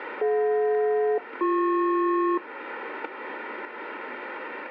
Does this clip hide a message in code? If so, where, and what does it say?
Yes: aircraft SELCAL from 0.2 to 2.4 s, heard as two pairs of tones. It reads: DJ-BP